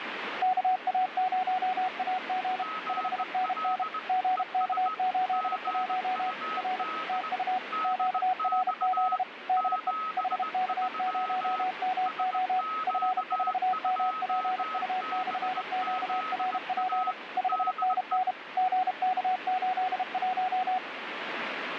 Morse code, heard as two keyed tones, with radio static. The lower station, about 32 wpm, 740 Hz: KA0AG 5NN GK81 R TU QRZ DE HK0MO F4MPU/QRP 5NN GK81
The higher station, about 19 wpm, 1280 Hz: GL ES GUD DX 73 SQ2BZA DE